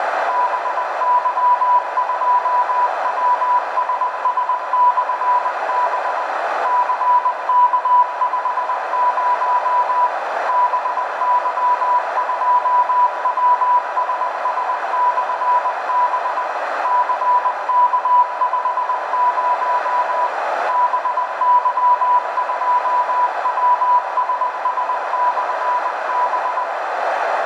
Morse code, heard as a keyed tone, machine-sent, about 20 wpm, 980 Hz, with radio static, a narrow filter and room echo. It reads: BY2WSS/B CK50 BY2WSS/B CK50 BY2WSS/B